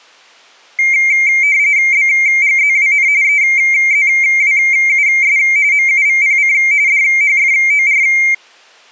RTTY (45.45 baud, 170 Hz shift), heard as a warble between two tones, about 2200 Hz centre. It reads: BGZWN EZWUS MUVPC DHFOR